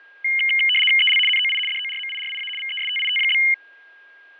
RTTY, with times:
1.0-1.2 EL
1.3-1.6 NOI
1.7-2.5 DORMIRIA
2.6-3.4 VESTIT?

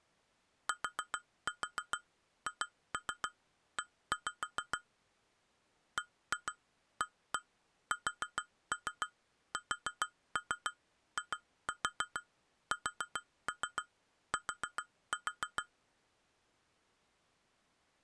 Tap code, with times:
0.7-4.8 THE
6.0-15.6 BASSIST

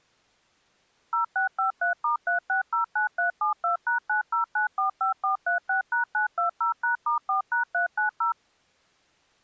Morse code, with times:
none

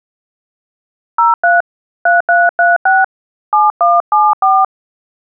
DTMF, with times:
1.2-1.6 03
2.1-3.0 3336
3.5-4.6 7174

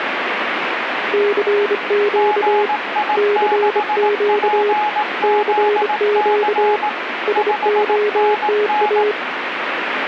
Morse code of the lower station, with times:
1.1-2.7 CQ
3.2-4.7 CQ
5.2-6.8 CQ
7.3-9.1 SOTA

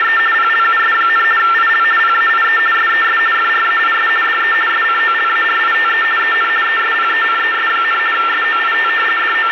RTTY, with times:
0.0-0.2 …
0.3-1.2 PLUS,
1.4-1.8 IL
2.0-2.6 PAIE
2.7-3.2 SES
3.3-4.1 FRAIS
4.2-4.5 DE
4.7-6.0 SCOLARITE
6.2-6.5 EN
6.6-8.0 ESPECES,
8.1-8.9 SOIT
9.2-9.5 …

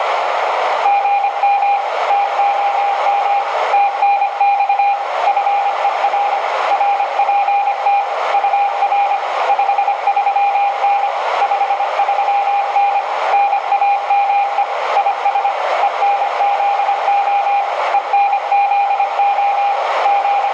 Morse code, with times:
0.9-1.8 GM
2.1-3.4 TOM
3.7-4.9 TNX
5.3-6.4 FER
6.7-8.0 RPT
8.3-9.2 UR
9.5-11.1 53N
11.4-13.0 53N
13.3-14.6 NAME
15.0-15.5 IS
15.8-17.6 ENZO
17.9-19.7 ENZO
20.1-20.5 …

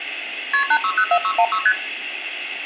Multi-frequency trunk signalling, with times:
0.5-0.6 KP
0.7-1.6 8604616
1.7-1.7 ST

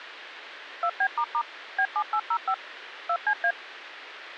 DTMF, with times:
0.8-1.4 2B**
1.8-2.5 B7805
3.1-3.5 2CA

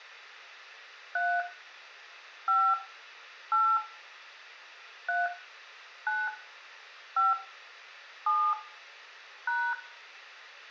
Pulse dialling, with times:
none

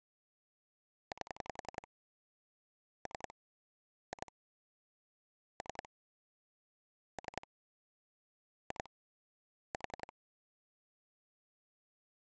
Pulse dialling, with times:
1.1-1.9 8
3.1-3.3 3
4.1-4.3 2
5.6-5.9 3
7.2-7.5 3
8.7-8.9 2
9.7-10.1 4

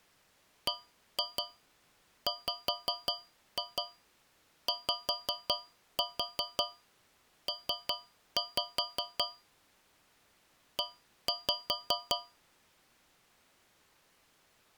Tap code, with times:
0.7-9.2 BWYP
10.8-12.2 E

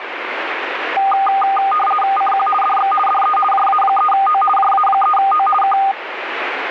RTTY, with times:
2.2-2.5 CQ
2.6-2.9 DX
3.1-3.4 DE
3.5-4.4 JA3O
4.6-5.5 JA3O
5.6-5.8 K

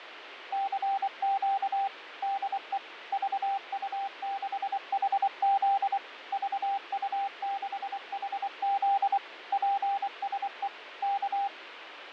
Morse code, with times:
0.5-1.9 CQ
2.2-2.8 DE
3.1-6.0 VU6HZ
6.3-9.2 VU6HZ
9.5-10.7 PSE
11.0-11.5 K

